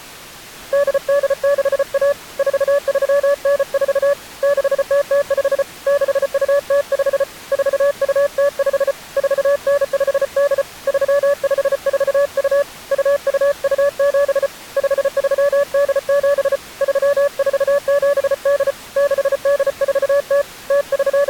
Morse code (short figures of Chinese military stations), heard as a keyed tone, hand-sent with a paddle, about 34 wpm, 570 Hz. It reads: 8861 4394 6005 6205 4205 4958 3542 2227 5387 3478 6840 …